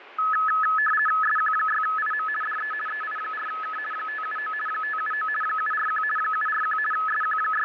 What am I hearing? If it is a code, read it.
RTTY (50 baud, 450 Hz shift), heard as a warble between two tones, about 1500 Hz centre, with radio static. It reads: SQ6IM DE EI4K 579 579 741 741 …